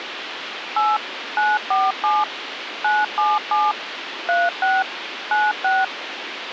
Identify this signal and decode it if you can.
DTMF, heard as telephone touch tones, dialled by machine, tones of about 200 ms, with radio hiss and a squelch burst at the end. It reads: 8 947 977 36 96